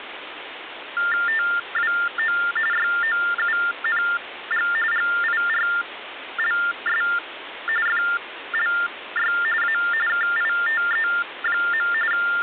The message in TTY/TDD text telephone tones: TWO YOUNG GIRLS FLY A KITE. …

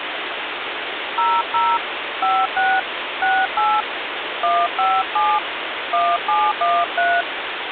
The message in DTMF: 00 56 68 157 1713

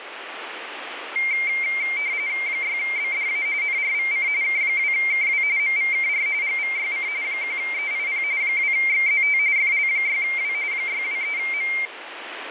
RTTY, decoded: 6BDA NRVC K2KW MVKR GVYC 1EIP 2XZT FL6W 623M

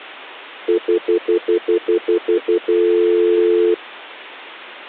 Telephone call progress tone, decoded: stutter dial tone

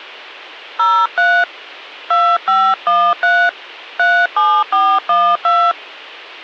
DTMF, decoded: 03 2513 37412

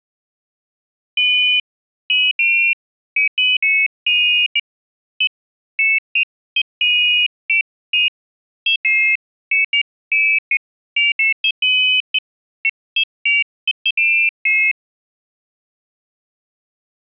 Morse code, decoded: none

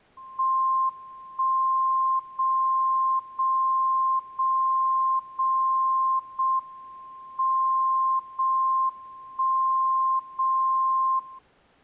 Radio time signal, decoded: 1 0 0 0 0 0 M 0 1 0 0

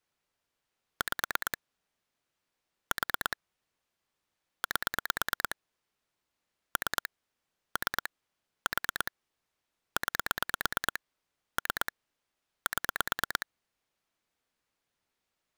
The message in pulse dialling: 5 4 8 3 3 4 9 3 7

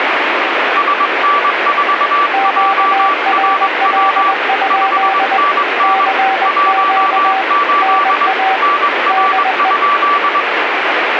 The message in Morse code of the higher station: SN4JRW 5NN 18 NR?

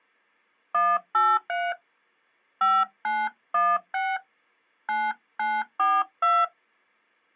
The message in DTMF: 183 5916 9942

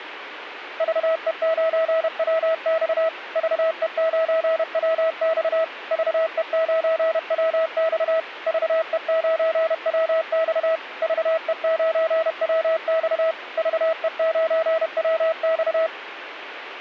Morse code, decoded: VE9WX VE9WX VE9WX VE9WX VE9WX VE9WX

